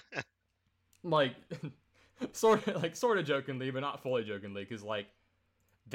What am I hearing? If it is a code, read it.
Speech in English. There is no code.